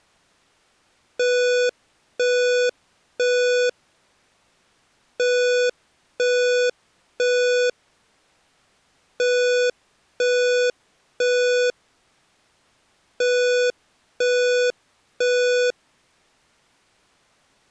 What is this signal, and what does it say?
Alarm pattern, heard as an alarm's beeps, played four times, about 490 Hz. Temporal three. Smoke or fire, evacuate.